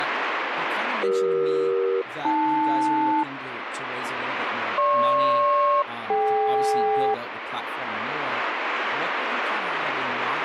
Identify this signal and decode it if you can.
Aircraft SELCAL, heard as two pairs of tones, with radio static and speech in English. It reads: CE-AL GP-DK